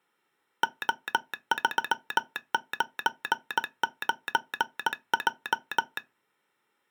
Morse code, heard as a telegraph sounder, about 18 wpm. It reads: O399J